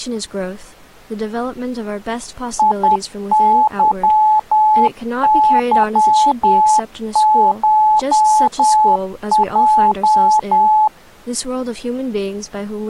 Morse code (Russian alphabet), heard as a keyed tone, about 10 wpm, 860 Hz, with speech in English. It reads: ИЫЫШЙ